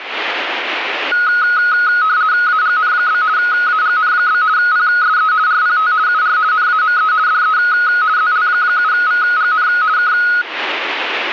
RTTY (50 baud, 170 Hz shift), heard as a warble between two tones, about 1360 Hz centre, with radio static. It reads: AGN? AGN? PSE RPT UR NAME DE ZL7VGN K